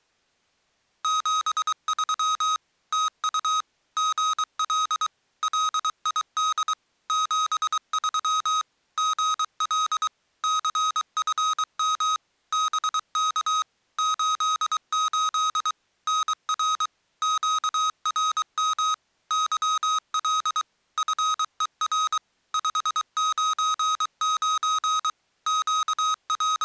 Morse code, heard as electronic beeps, machine-sent, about 23 wpm, 1260 Hz. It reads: 73 TU GL LID 73 GL CFM BK 88 NR QRM YL FER 599 …